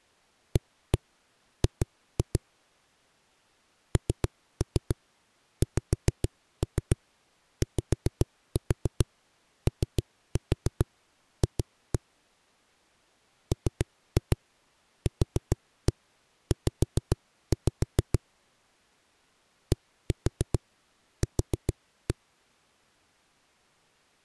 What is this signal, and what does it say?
Tap code, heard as knocks on a wall, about 7 knocks a second. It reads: AG NXYOF MQZ DQ